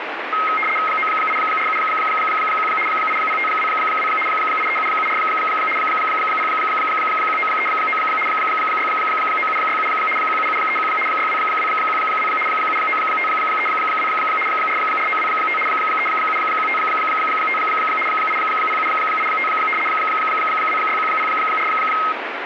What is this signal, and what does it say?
RTTY (75 baud, 850 Hz shift), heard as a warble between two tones, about 1700 Hz centre, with radio static. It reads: 98471 80522 83774 01939 69767 17731 62212 79532 44925 37155 80785 26104